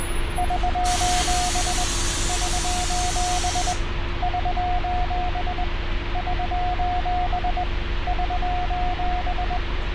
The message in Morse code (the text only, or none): <SOS> <SOS> <SOS> <SOS> <SOS>